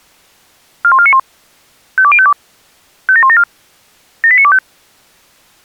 Five-tone selective call (ZVEI), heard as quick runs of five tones, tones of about 70 ms. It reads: 41491 52052 57174 78925